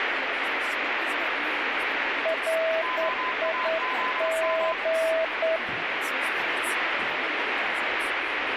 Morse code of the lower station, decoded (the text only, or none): RIG